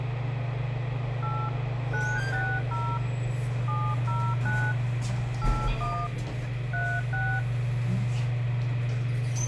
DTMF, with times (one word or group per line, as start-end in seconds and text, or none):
1.2-1.5 8
1.9-3.0 960
3.7-4.7 709
5.4-6.1 81
6.7-7.4 36